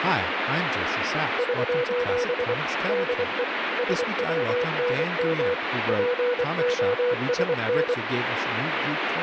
Morse code, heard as a keyed tone, machine-sent, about 24 wpm, 490 Hz, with radio static and speech in English. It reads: <SOS> DE SWNM POSN